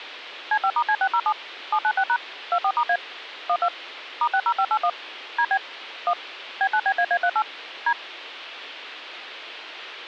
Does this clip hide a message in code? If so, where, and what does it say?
Yes: DTMF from 0.5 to 7.9 s, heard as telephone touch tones, dialled by machine, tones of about 70 ms. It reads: C5*C607 796# 24*A 12 *60581 DB 1 B9BAA38 D